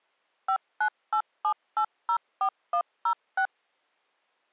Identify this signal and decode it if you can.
DTMF, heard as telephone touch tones, dialled by machine, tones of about 80 ms. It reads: 5987804106